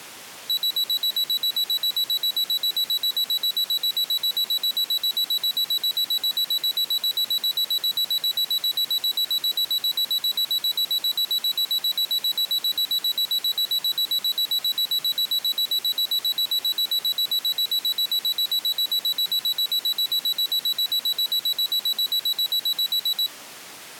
Evenly repeated beeps. There is no code.